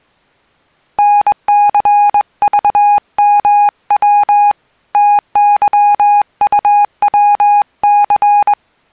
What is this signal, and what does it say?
Morse code, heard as a keyed tone, hand-sent with a straight key, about 21 wpm, 820 Hz. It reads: NCVMW TYUWC